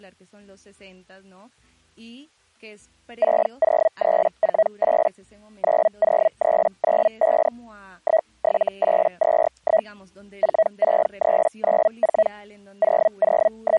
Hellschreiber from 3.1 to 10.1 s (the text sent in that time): 60348 90395 17821